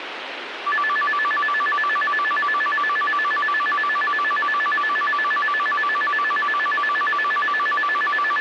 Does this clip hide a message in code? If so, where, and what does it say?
No, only a tone that alternates evenly between two pitches, with radio hiss.